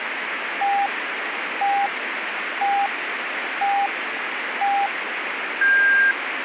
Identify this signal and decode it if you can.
Radio time signal (five pips and a higher one, as on Chinese radio), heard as pips, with radio static.